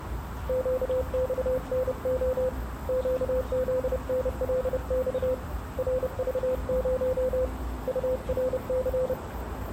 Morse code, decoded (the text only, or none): QXNO QZNLX RV0 URC